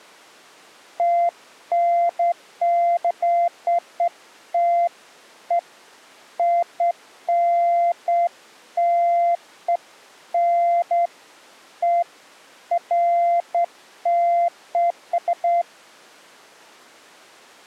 Beeps of irregular length. There is no code.